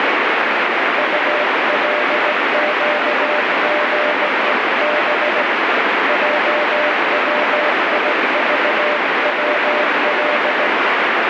Morse code (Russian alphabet), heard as a keyed tone, hand-sent with a straight key, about 17 wpm, 600 Hz, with heavy radio static. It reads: УЛЩГЕБ ЙВИЖВЛ